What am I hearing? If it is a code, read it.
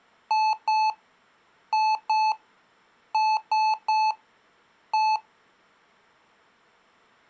Beep code, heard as beeps from a small speaker, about 870 Hz. 2-2-3-1. In Phoenix BIOS tables: unexpected interrupt.